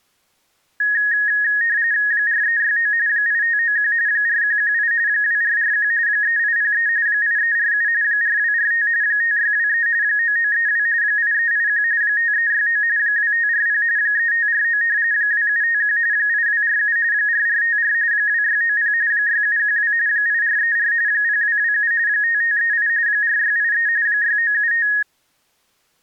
RTTY (45.45 baud, 170 Hz shift), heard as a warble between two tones, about 1750 Hz centre. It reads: 4369 8591 4118 2441 3803 8347 4245 5623 9932 8381 5369 2540 3549 2751 8247 4454 2690 6712 8434 0227 5538 4683 6975